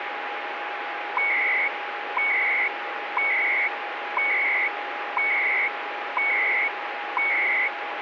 Radio time signal (CHU, Canada), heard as beeps and data bursts, one a second, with radio static.